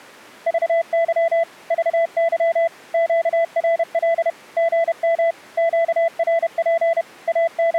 Morse code, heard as a keyed tone, machine-sent, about 31 wpm, 670 Hz. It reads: VY VY QRL GM QRP …